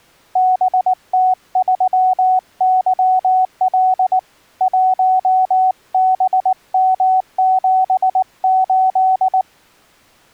Morse code, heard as a keyed tone, hand-sent with a paddle, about 19 wpm, 750 Hz. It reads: BT3YL 1BM78